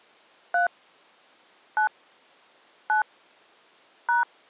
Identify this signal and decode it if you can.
DTMF, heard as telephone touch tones, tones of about 130 ms. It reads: 3 9 9 #